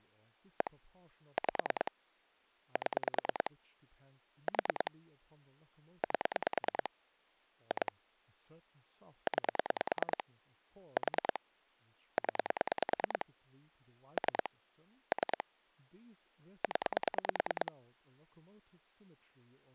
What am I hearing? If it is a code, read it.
Pulse dialling, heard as clicks on a phone line, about 9 pulses a second, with speech in English. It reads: 1 5 7 4 8 2 9 4 0 3 3 0